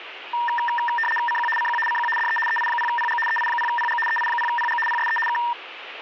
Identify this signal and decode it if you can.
RTTY (75 baud, 850 Hz shift), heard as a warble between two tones, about 1380 Hz centre, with radio static. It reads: CQ CQ CQ DE EI0PG EI0PG EI0PG PSE K